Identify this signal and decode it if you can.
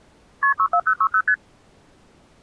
Multi-frequency trunk signalling (R1, as on North American trunks), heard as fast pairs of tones, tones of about 70 ms. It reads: KP 64060 ST